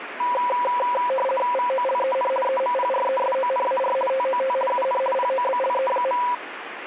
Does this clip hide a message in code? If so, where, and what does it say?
Yes: RTTY (50 baud, 450 Hz shift) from 0.2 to 6.3 s, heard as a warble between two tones, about 760 Hz centre, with radio static. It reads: VOLEN EMPRESONAR TOT UN POBLE.